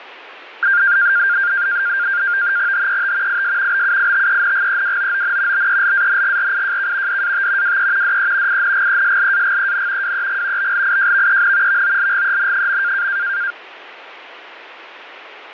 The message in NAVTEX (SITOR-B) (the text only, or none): HET IS BUITENGEWOON BELANGRIJK DAT WE DE INGESLAGEN WEG BLIJVEN VOLGEN.